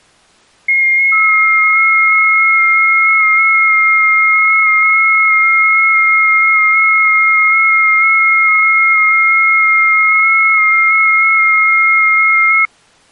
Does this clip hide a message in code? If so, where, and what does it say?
Yes: FT8 (several signals at once) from 0.7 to 12.7 s, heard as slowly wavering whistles, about 6.25 baud.